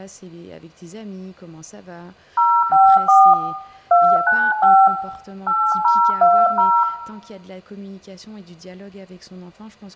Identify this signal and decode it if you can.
DTMF, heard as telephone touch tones, dialled by hand, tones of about 260 ms, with room echo. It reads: 054 295 8020